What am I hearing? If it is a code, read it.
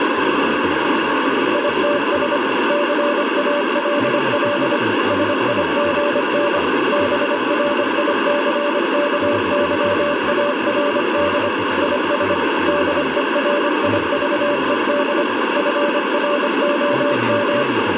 Morse code, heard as a keyed tone, machine-sent, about 25 wpm, 580 Hz, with radio static. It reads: ITS CALL SIGN BRICKYARD IS DERIVED FROM